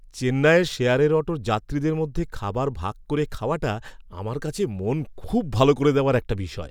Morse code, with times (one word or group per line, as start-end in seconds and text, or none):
none